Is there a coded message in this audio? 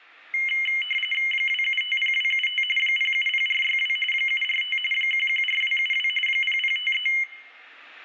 Yes: RTTY (45.45 baud, 850 Hz shift) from 0.3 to 7.2 s, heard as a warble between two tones, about 2550 Hz centre, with room echo. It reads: 2750275 070462 745 114272 0053